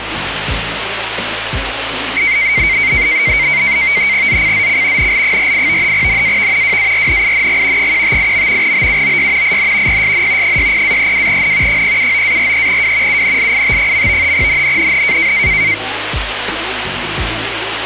NAVTEX (SITOR-B), 100 baud, 170 Hz shift, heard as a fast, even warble, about 2150 Hz centre, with radio static. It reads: ZCZC NL48 NAV WARNING 158. BUOY IN PSN 60-32N 079-43W UNLIT. NNNN